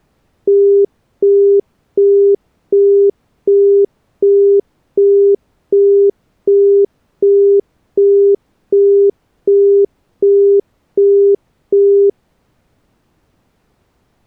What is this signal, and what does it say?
Telephone call progress tone (as in the UK, Australia and similar networks), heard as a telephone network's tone, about 400 Hz, 0.375 s on and 0.375 s off. Busy tone.